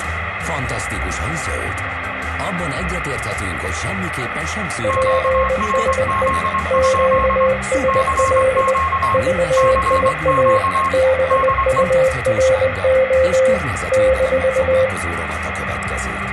Morse code, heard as two keyed tones, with radio static and room echo. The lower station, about 20 wpm, 520 Hz: PSE QSL VIA BURO -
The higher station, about 24 wpm, 1080 Hz: QRZ? CQ CQ DE